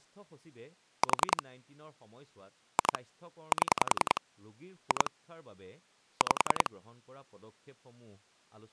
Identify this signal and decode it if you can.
Pulse dialling, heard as clicks on a phone line, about 10 pulses a second, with speech in Assamese. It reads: 4 2 7 2 5